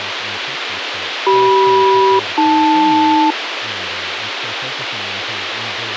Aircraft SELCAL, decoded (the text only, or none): CM-AL